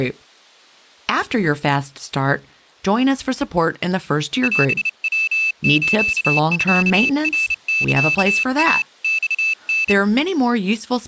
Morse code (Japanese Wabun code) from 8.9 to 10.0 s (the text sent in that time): マタ